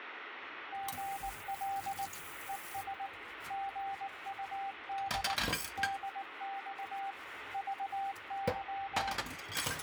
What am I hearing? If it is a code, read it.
Morse code, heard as a keyed tone, machine-sent, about 19 wpm, 790 Hz, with radio static and kitchen noise. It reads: GL ES GUD DX VY